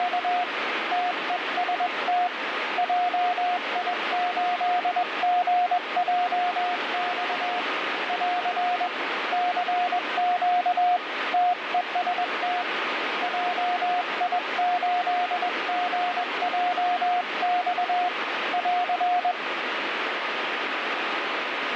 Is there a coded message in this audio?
Yes: Morse code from 0.0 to 19.4 s, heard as a keyed tone, hand-sent with a paddle, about 21 wpm, 720 Hz, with heavy radio static. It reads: … TEST JI8GJX <AR> CQ TEST JI8GJX <AR>